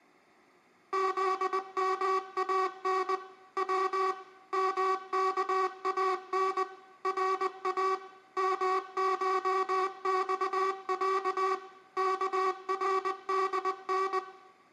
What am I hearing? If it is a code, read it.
Morse code (Persian alphabet), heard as a buzzer, machine-sent, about 20 wpm, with room echo. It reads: زمان و مکان را مشخص کردن